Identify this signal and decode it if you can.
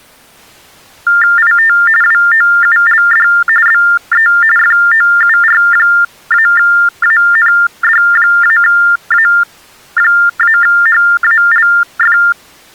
TTY/TDD text telephone tones (45.45 baud Baudot), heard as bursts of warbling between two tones, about 400 Hz shift, 1600 Hz centre. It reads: IT WOULD BE FOUR-AND-A-HALF